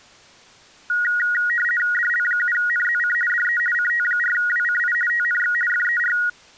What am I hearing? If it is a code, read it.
RTTY (50 baud, 450 Hz shift), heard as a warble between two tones, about 1650 Hz centre. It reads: DL7NZC DE CT4WCI TNX FER